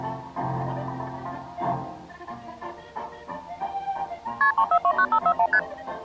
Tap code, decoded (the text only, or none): none